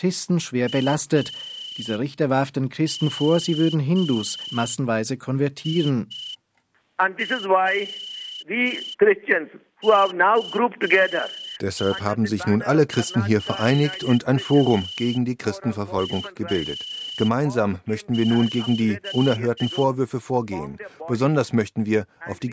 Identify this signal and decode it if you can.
Morse code (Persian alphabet), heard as a whistle, hand-sent with a straight key, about 5 wpm. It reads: امیرفواد